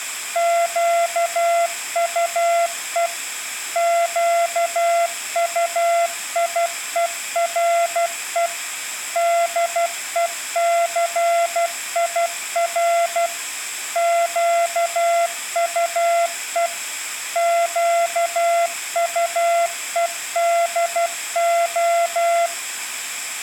Morse code, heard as a keyed tone, machine-sent, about 12 wpm, 680 Hz, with room echo. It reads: QUE QUIERE DECIR QUE QUEDO